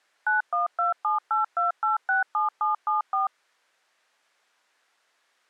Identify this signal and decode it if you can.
DTMF, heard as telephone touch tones, dialled by machine, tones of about 140 ms. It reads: 912782867774